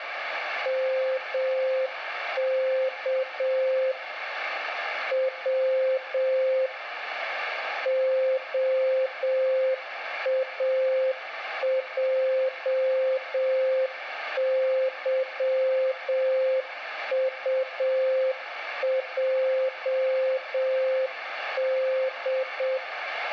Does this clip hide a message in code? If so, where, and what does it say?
Yes: Morse code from 0.6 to 22.8 s, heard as a keyed tone, machine-sent, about 7 wpm, 520 Hz, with radio static and room echo. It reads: MK W OAJYUJD